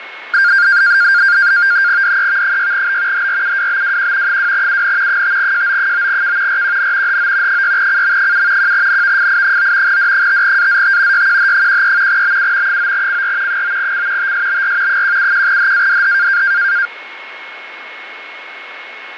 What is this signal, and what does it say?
NAVTEX (SITOR-B), 100 baud, 170 Hz shift, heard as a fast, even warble, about 1500 Hz centre, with radio static, fading and a steady whistle near 2180 Hz. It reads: DEV6B HRUWBWQ 2UN 5JO9K RQN HO 6CM7 1NVFI9 D5AZT YQH13 BU 9CR 9C TSBR 171HADH